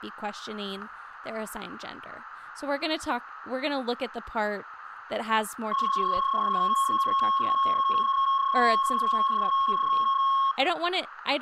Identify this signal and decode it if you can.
PSK31 (31.25 baud), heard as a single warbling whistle, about 1090 Hz, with room echo and speech in English.